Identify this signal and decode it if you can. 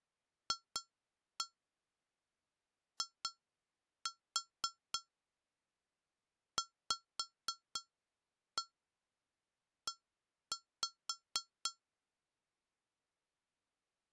Tap code, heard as taps on glass, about 4 knocks a second. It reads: FIVE